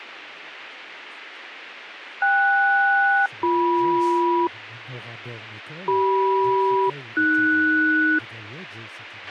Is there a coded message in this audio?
Yes: aircraft SELCAL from 2.2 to 8.2 s, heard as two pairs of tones, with a squelch burst at the end and speech in French. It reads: KS-BM CM-AS